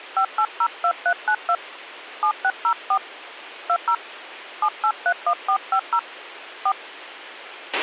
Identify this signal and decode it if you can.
DTMF, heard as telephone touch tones, dialled by hand, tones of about 70 ms, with a squelch burst at the end. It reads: 5802392 7604 20 7831450 4